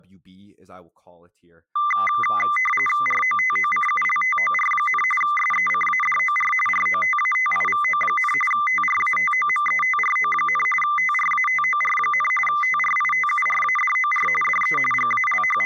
RTTY (45.45 baud, 850 Hz shift), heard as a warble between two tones, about 1600 Hz centre, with speech in English. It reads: ROTOCULTOR, SECADOR ROTATIVO, TRATOMETRO, TRATOR, TRITURADOR DE …